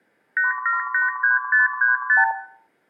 Multi-frequency trunk signalling (R2, with the far end's replies), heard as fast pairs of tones, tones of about 140 ms, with room echo. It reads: 8783535